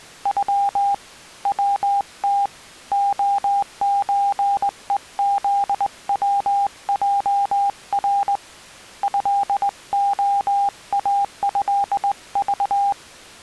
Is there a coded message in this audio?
Yes: Morse code (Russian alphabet) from 0.2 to 13.0 s, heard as a keyed tone, hand-sent with a straight key, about 20 wpm, 800 Hz. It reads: Ю ВТ ОЧЕЗВЙР ЭОАЭЖ